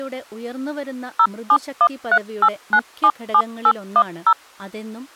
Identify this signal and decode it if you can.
DTMF, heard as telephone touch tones, dialled by machine, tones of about 60 ms, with speech in Malayalam. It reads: 07138977810